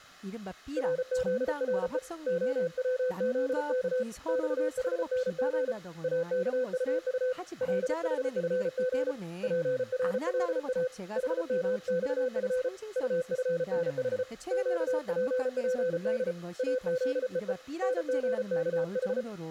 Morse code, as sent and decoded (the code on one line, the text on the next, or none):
.-. --.. .-. . / --- .-- --.. -.- / -..- .... -. --. / .- -.- ..- ..- / .-.. .... ..-. --. / .--. .-. .-.. .- / .... -- -..- ..-. / ..- ..-. -. .... / --.- .--. .--. -.. / .- --.. . . / -. --. -.- ....
RZRE OWZK XHNG AKUU LHFG PRLA HMXF UFNH QPPD AZEE NGKH